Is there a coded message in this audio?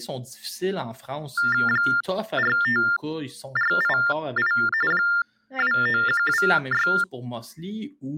Yes: TTY/TDD text telephone tones (45.45 baud Baudot) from 1.4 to 7.0 s, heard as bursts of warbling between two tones, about 400 Hz shift, 1600 Hz centre, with speech in French. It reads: 45488 29126